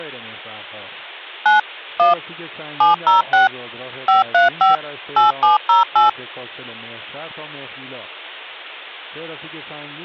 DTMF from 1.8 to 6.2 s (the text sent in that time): 1 706 535 8708